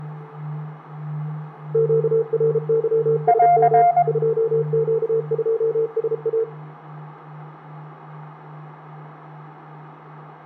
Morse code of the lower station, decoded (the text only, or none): QRYSM 2Q2SA